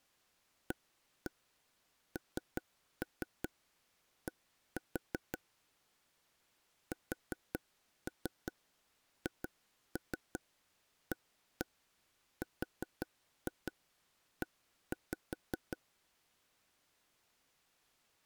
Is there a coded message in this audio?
Yes: tap code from 0.7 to 15.8 s, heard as taps on a table, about 5 knocks a second. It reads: AND SHARE